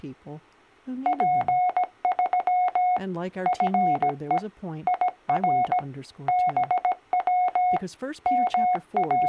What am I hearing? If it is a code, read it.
Morse code, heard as a keyed tone, machine-sent, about 17 wpm, 730 Hz, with speech in English. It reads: P3 FE IR BW …